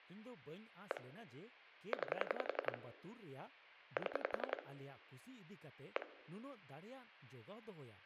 Pulse dialling, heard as clicks on a phone line, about 11 pulses a second, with hum, room echo and speech in Santali. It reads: 1 9 7 1